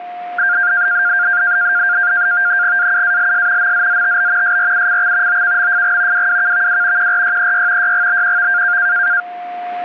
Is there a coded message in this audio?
Yes: NAVTEX (SITOR-B), 100 baud, 170 Hz shift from 0.4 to 9.2 s, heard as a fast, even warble, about 1500 Hz centre, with static crashes and a steady whistle near 710 Hz. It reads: AUALS MZZTB SRUCX OKMFG WWKVW QRYEY YGBQV